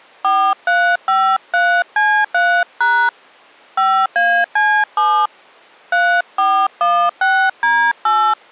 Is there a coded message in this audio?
Yes: DTMF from 0.2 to 8.3 s, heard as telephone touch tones, dialled by hand, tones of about 290 ms. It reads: 4353C3# 5AC7 3416D8